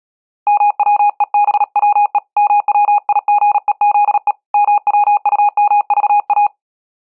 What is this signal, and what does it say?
Morse code, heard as a keyed tone, hand-sent with a paddle, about 37 wpm, 830 Hz. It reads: MWEBWE MWIGEZE MWUMVA